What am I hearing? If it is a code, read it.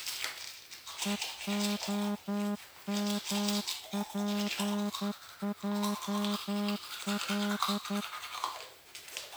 Morse code (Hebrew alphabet), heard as a horn, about 11 wpm, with the noise of a restroom. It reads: והמפעל